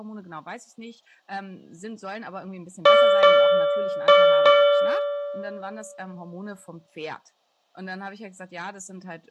Ship's bell, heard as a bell, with room echo and speech in German. 4. Four half-hours of the watch have passed.